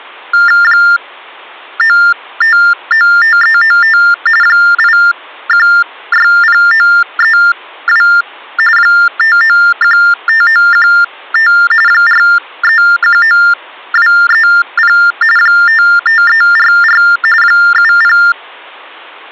TTY/TDD text telephone tones (45.45 baud Baudot), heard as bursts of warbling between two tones, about 400 Hz shift, 1600 Hz centre. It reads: 9595395 8160932 5915915 4319230 55344 70